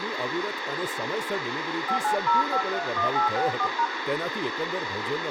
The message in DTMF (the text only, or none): 590531864#